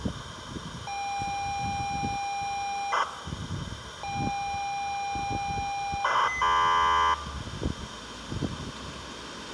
ZX Spectrum tape loading, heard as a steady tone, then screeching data, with tape hiss, room echo and street noise.